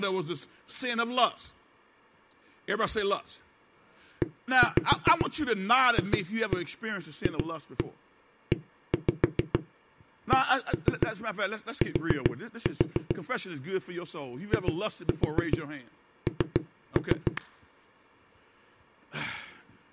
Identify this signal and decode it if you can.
Tap code, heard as knocks on a wall, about 7 knocks a second, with speech in English. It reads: EFFECT IN